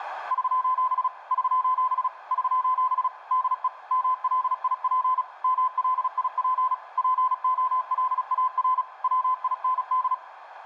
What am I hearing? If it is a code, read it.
Morse code, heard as a keyed tone, machine-sent, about 36 wpm, 1020 Hz, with radio static. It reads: <SOS> <SOS> <SOS> DE MLIP MLIP POLAR WIND